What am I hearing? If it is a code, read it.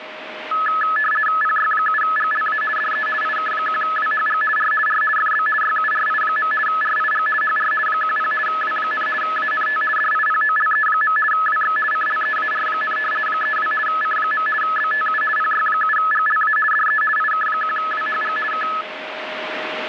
RTTY (50 baud, 450 Hz shift), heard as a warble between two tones, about 1500 Hz centre, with radio static and a steady whistle near 620 Hz. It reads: PY7GLA DE IK1WHG R R FB YURI. RIG HR 10 W, ANT DIPOLE. WX CLEAR, 32 C. BTU PY7GLA DE IK1WHG K